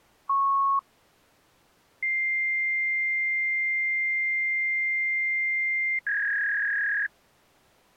Fax machine handshake, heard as a beep, a long tone and a warble.